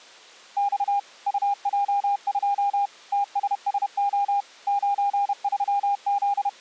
Morse code, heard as a keyed tone, machine-sent, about 31 wpm, 810 Hz. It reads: X UJ2 TSSO …